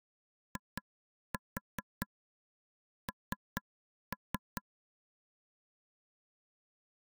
Tap code, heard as taps on a table, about 4 knocks a second. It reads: IN